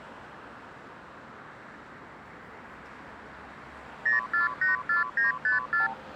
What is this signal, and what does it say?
Multi-frequency trunk signalling (R2, with the far end's replies), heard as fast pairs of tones, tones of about 140 ms, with street noise. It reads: 0484954